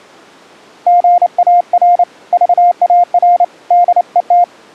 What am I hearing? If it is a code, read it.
Morse code, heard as a keyed tone, hand-sent with a paddle, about 29 wpm, 700 Hz. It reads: GAR VAR DET